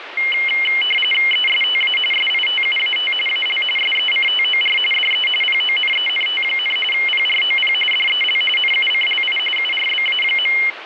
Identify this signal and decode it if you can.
RTTY (45.45 baud, 850 Hz shift), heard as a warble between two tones, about 2550 Hz centre, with radio static. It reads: ESTA SITUAT AL SECTOR DE PONENT, PROP DEL NUCLI URBA.